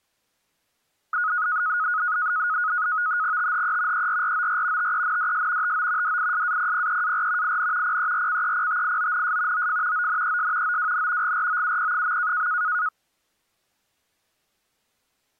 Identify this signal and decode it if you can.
NAVTEX (SITOR-B), 100 baud, 170 Hz shift, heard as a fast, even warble, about 1360 Hz centre. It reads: THE ERROR TENDS TO DISAPPEAR IN PERCEPTIONS OF ONES OWN GROUP.